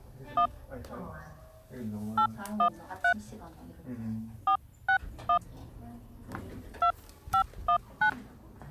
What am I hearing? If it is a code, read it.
DTMF, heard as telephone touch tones, dialled by hand, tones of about 90 ms, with the noise inside a lift. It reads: 1 813 461 2519